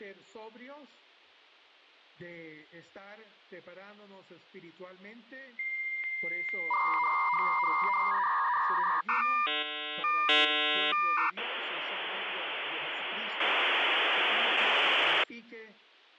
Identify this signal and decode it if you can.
Dial-up modem handshake (V.34 or later), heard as a whistle, warbles, then hiss.